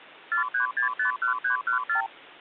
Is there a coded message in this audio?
Yes: multi-frequency trunk signalling (R2, with the far end's replies) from 0.3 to 2.1 s, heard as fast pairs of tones, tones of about 110 ms, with hum. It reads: 43651314